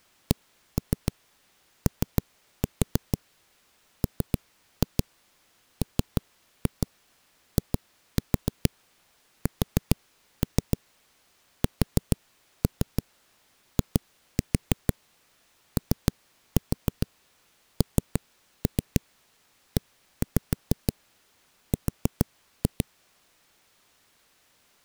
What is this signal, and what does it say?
Tap code, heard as knocks on a wall, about 6 knocks a second. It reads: COMMISSIONER